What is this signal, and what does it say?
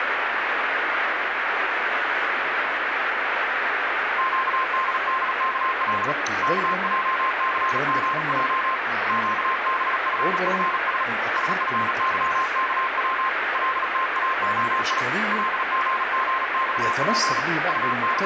Morse code, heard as a keyed tone, hand-sent with a paddle, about 37 wpm, 1050 Hz, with radio static. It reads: QDDKL KJCGJ QBFFS SFYKW LTAOI LGGXP …